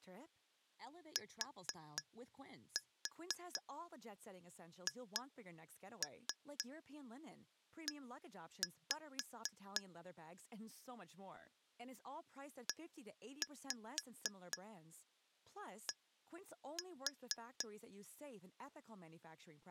Tap code, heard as taps on glass, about 4 knocks a second, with speech in English. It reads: THE ED